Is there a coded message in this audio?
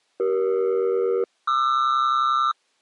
Yes: aircraft SELCAL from 0.2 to 2.5 s, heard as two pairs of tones. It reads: CE-QR